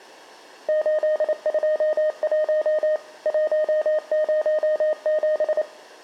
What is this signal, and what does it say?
Morse code, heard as a keyed tone, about 28 wpm, 620 Hz, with room echo. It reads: 821 107